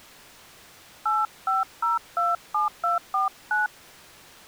DTMF, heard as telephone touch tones, dialled by hand, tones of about 160 ms. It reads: 85027249